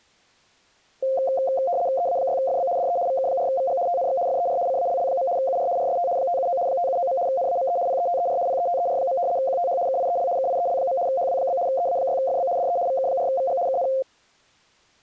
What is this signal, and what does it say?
RTTY (75 baud, 170 Hz shift), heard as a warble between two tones, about 620 Hz centre. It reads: EA6FB DE VK4VG TNX FER CALL. UR RST 579 579. NAME PETER PETER. QTH KIEL KIEL. HW? EA6FB DE VK4VG KN